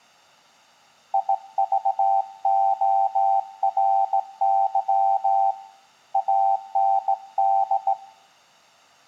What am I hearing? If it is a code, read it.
Morse code, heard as a keyed tone, hand-sent with a straight key, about 17 wpm, 780 Hz, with room echo. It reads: IVORY AND